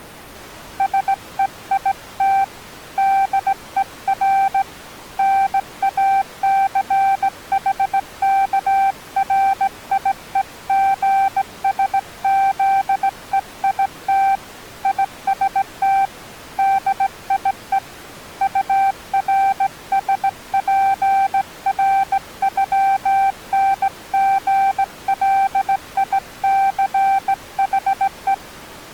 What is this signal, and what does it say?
Morse code (with German letters), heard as a keyed tone, hand-sent with a straight key, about 17 wpm, 780 Hz. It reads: SEIT DER NACHKRIEGSZEIT IST DIE URSPRÜNGLICHE